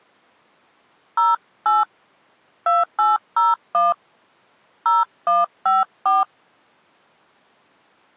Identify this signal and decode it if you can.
DTMF, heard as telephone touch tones, dialled by hand, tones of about 180 ms. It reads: 08 2801 0154